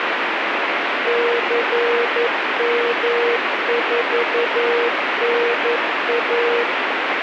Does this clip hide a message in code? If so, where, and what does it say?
Yes: Morse code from 1.0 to 6.7 s, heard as a keyed tone, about 11 wpm, 470 Hz, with heavy radio static. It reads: CM4NA